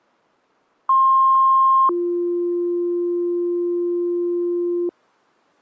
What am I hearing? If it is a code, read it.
Two-tone page, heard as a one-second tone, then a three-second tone, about 1060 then 350 Hz.